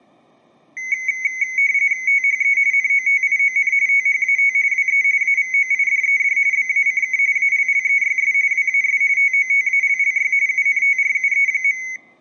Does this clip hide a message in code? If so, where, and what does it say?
Yes: RTTY (45.45 baud, 170 Hz shift) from 0.8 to 12.0 s, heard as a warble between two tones, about 2150 Hz centre, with room echo. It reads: THE NOTION THAT WE AVOIDED BACK ALLEYS WAS TOTALLY UNTRUE.